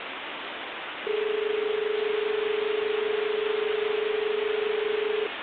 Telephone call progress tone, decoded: dial tone

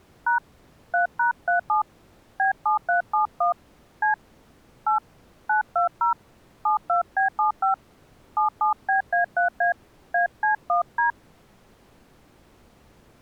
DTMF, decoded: # 3#37 B7371 C 8 920 72B75 77BA3A AC1D

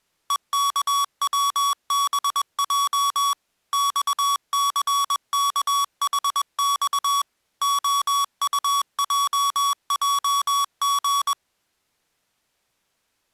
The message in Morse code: EKWBJ XCKHX OUJJG

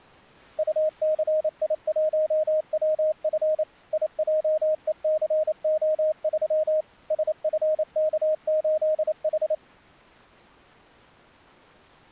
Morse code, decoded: UCI1WF IJECO3 SFK8H

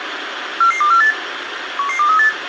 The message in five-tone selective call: 44248 11238

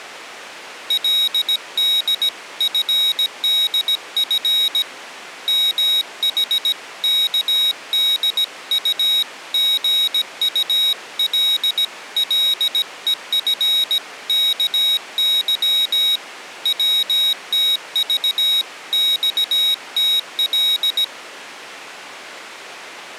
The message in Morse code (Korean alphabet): 그는 무의식간에 벌컥

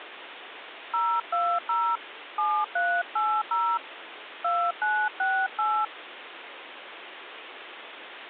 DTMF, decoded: 020 7380 2968

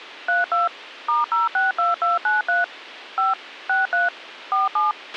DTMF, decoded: 32 *062293 5 63 47

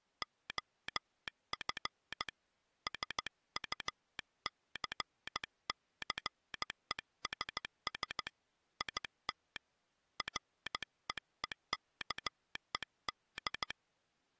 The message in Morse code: OF SUCCESS IT REEKED

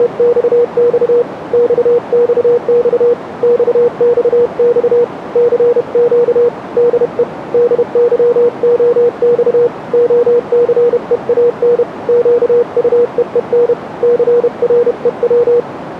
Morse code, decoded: … XXX XXX CQ DE DYOX OCEAN QUEEN CREW

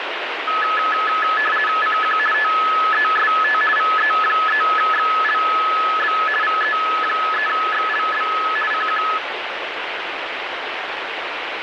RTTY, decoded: CQ TEST VE3XLB VE3XLB CQ

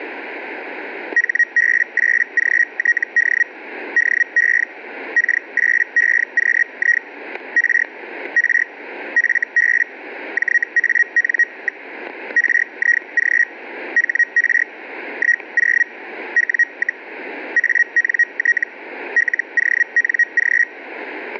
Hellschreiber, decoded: HB8GTD DE K8EQI R R FB JAN. RIG HR 10 W, ANT LONG

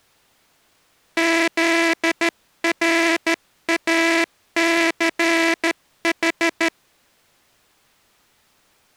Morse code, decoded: ZRACH

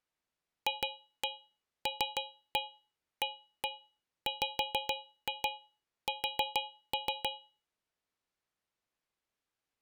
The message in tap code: FLAWS

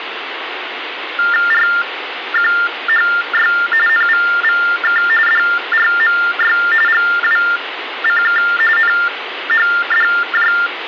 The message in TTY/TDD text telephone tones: RQHY NVVK DRMY GWCK NHDJ

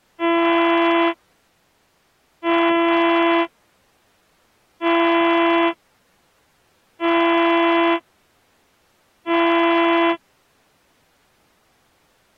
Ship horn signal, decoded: 5 short

